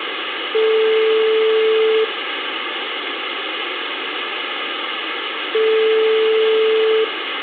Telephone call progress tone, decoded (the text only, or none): ringback tone